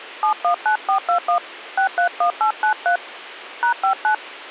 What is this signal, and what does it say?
DTMF, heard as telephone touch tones, dialled by hand, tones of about 100 ms. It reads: 719421 631893 #59